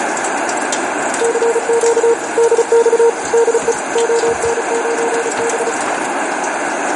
Morse code, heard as a keyed tone, machine-sent, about 35 wpm, 460 Hz, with radio static and kitchen noise. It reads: CQ DX DE ON9B